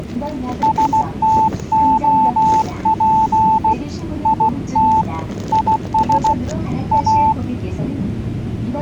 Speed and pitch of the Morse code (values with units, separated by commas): 16 wpm, 880 Hz